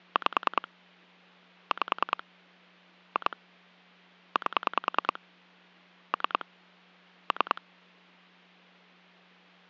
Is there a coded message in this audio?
Yes: pulse dialling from 0.2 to 7.6 s, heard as clicks on a phone line, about 10 pulses a second. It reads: 5 5 2 8 3 3